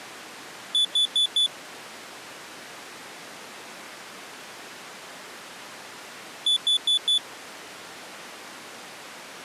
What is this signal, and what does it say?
Alarm pattern, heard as an alarm's beeps, played twice, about 3450 Hz. Temporal four. Carbon monoxide.